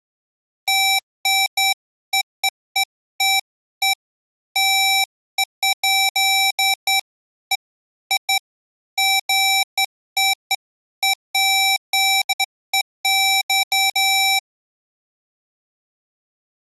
Beeps of irregular length. There is no code.